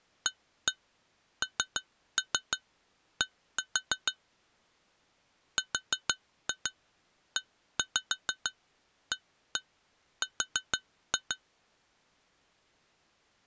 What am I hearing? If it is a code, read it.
Tap code, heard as taps on glass, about 6 knocks a second. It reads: AND REAR